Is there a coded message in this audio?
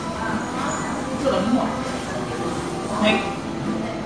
No, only the noise of a crowd indoors.